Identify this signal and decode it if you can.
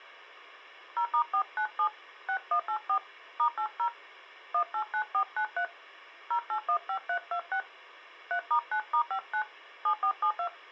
DTMF, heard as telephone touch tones, dialled by hand, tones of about 80 ms. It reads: 0*497 6184 *80 189493 0815326 3*9*59 7472